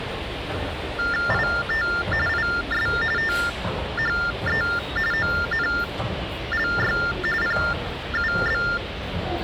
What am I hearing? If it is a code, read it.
TTY/TDD text telephone tones (45.45 baud Baudot), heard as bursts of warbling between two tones, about 400 Hz shift, 1600 Hz centre, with phone line noise and the noise of a subway station. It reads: IT IS THE ONLY PUB